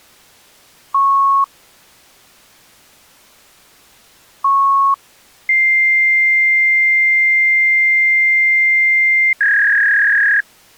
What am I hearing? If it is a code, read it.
Fax machine handshake, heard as beeps, a long tone and a warble.